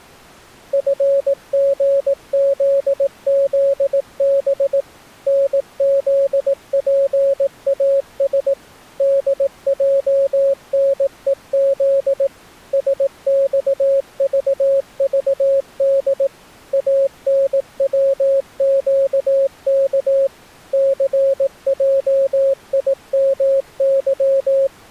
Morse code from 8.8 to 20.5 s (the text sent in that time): DJNEZ SXVVD ANWQK